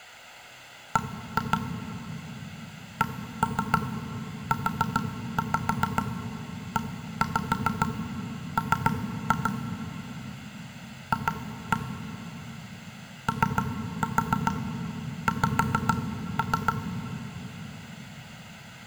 Tap code, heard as knocks on wood, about 7 knocks a second, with room echo. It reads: B CUEM F OX